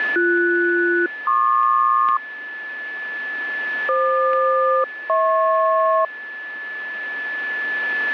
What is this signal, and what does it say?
Aircraft SELCAL, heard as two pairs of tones, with a steady whistle near 1730 Hz. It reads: BS-PQ FQ-HP